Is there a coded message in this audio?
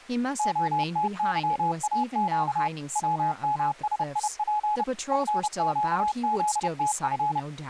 Yes: Morse code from 0.3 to 7.5 s, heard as a keyed tone, machine-sent, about 30 wpm, 840 Hz, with speech in English. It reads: OTYAQ WMSIP FQZTF